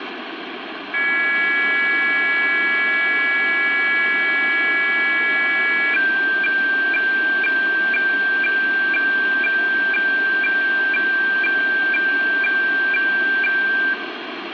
Weather fax (radiofax), 120 lines a minute, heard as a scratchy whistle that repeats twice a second, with radio static and room echo.